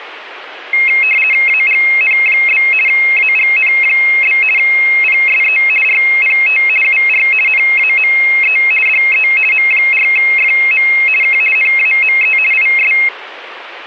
RTTY (50 baud, 450 Hz shift), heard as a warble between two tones, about 2350 Hz centre. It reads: AGN? AGN? PSE RPT UR NAME DE M4FM K NAME IS